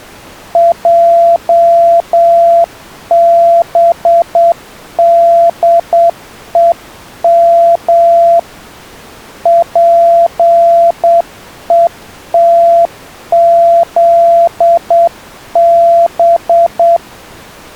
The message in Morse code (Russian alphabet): ЙБДЕМ ПЕТЗБ

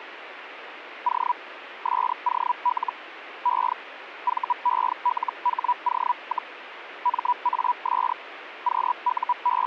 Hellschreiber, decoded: O SOL E VELHO, MAS …

